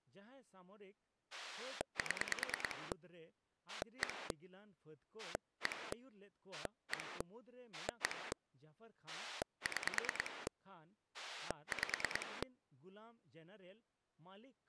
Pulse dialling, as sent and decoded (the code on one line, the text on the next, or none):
7 / 1 / 1 / 1 / 1 / 6 / 5
7 1 1 1 1 6 5